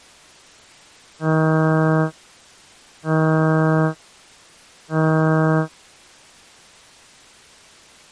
Ship horn signal, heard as a ship's horn, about 160 Hz. 3 short. At sea: I am operating astern propulsion.